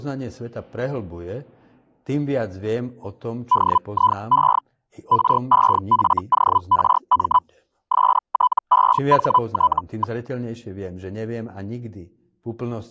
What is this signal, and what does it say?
Hellschreiber (Feld-Hell, 122.5 baud), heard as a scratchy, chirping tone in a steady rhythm, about 1000 Hz, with speech in Slovak. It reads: DIE REFORM STEHT.